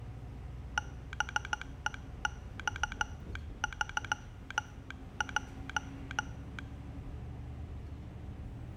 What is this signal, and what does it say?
Morse code, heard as a telegraph sounder, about 15 wpm, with the noise inside a bus. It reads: BEX3J